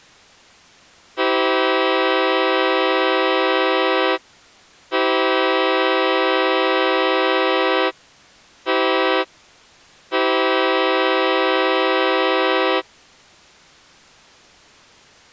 Train horn signal, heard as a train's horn. 2 long, 1 short, 1 long. On North American railways: approaching a public crossing.